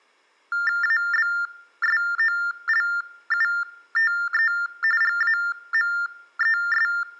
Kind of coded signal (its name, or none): TTY/TDD text telephone tones